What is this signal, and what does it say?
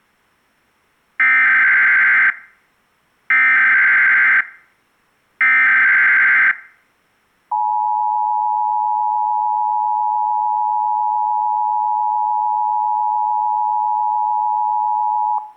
Emergency Alert System (SAME) tones (header bursts, then the 853 and 960 Hz attention tone), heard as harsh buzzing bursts, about 520.83 baud.